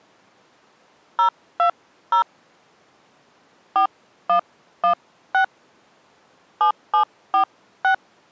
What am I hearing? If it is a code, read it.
DTMF, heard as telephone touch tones, dialled by hand, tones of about 100 ms. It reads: 020 4116 7746